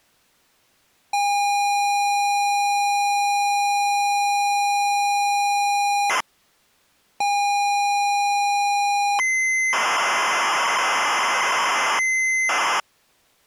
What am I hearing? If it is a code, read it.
ZX Spectrum tape loading, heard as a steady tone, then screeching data.